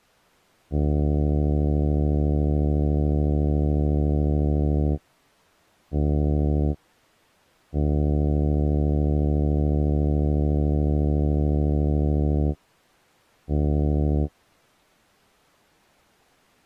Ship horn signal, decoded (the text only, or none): 1 long, 1 short, 1 long, 1 short